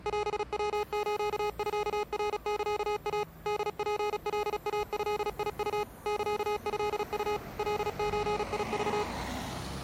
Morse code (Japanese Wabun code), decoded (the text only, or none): オヤスミナサイ ホツカイドウ サトウ カゾク